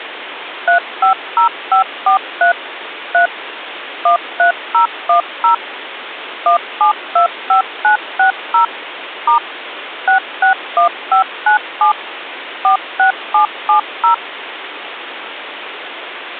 DTMF, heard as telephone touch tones, dialled by machine, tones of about 110 ms, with phone line noise. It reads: 350543 3 13010 1725960 * 661597 46770